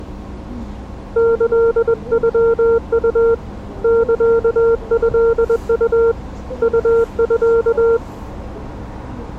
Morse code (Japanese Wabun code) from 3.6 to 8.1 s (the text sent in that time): サトウ ウミ